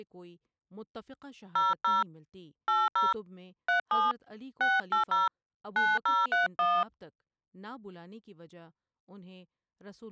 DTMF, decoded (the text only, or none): 00 80 37 680 9031